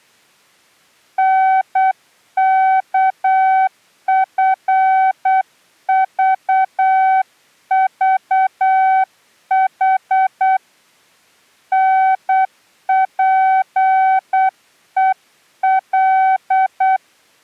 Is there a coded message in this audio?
Yes: Morse code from 1.1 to 17.0 s, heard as a keyed tone, hand-sent with a paddle, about 8 wpm, 760 Hz. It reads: NKFVVH NPEL